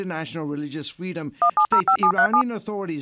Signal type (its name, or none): DTMF